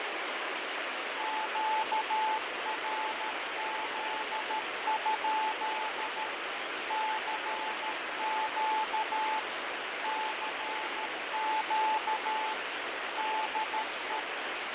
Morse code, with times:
1.2-6.3 QRZ?
6.9-9.4 CQ
10.0-12.5 CQ
13.2-14.2 DE

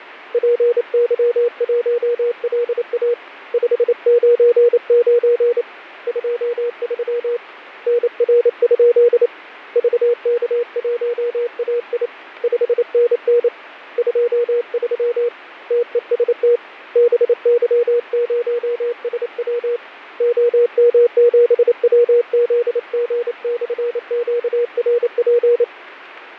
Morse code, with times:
0.3-3.1 PY1LA
3.5-5.6 599
6.1-7.4 23
7.9-9.3 NR?
9.8-12.1 VK1AI
12.4-13.5 5NN
14.0-15.3 23
15.7-16.6 TEST
17.0-19.8 BY0SW
20.2-25.6 OM7WZG/QRP

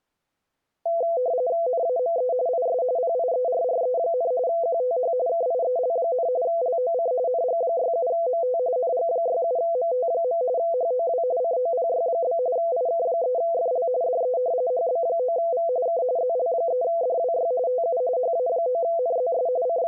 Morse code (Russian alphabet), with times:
none

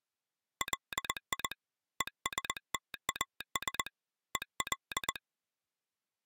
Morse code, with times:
0.6-1.5 LI
2.0-3.9 ESTAS
4.4-5.2 EL

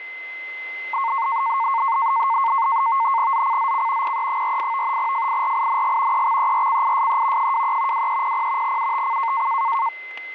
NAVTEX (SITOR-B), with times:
3.3-4.2 ZCZC
4.0-5.0 PE48
5.0-6.3 FIRING
6.1-7.5 EXERCISE
7.4-8.1 23
7.9-8.8 2300
8.6-9.5 UTC

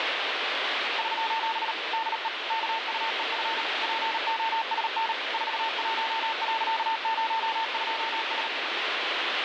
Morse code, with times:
1.0-1.7 <SOS>
1.9-2.3 DE
2.5-3.6 KUEF
3.8-5.1 POSN
5.3-8.5 41.02S

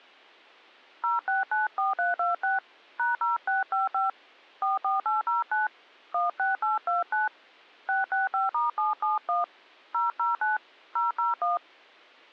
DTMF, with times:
1.0-2.6 0694326
3.0-4.1 #0655
4.6-5.7 44809
6.1-7.3 16829
7.9-9.4 665*771
9.9-10.6 009
11.0-11.6 001

